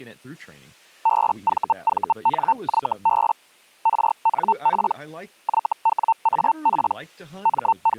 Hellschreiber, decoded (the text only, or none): BVVNYB RNP YWAP …